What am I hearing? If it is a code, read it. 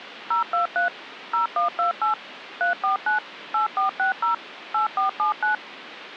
DTMF, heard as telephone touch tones, dialled by machine, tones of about 120 ms, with phone line noise. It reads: 023 0128 349 8460 8479